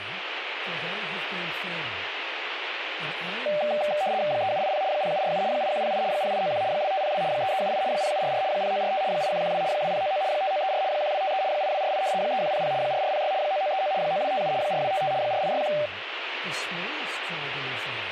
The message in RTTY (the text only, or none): 3780 0747 8108 0891 2502 3378 0744 0945 8112 2099 5934 1253 8248 3100 4406 9939 9257 4255 4861